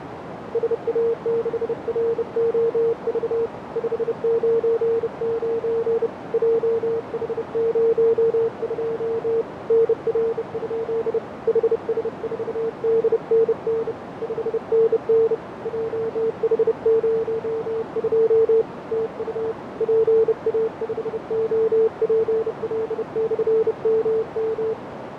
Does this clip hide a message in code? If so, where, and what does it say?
Yes: Morse code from 0.5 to 24.8 s, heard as a keyed tone, hand-sent with a bug key, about 30 wpm, 450 Hz, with radio static, fading and a narrow filter. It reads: SA6ROV 599 JH02 NR? HS4DNN 5NN JH02 TU PA5OPL/MM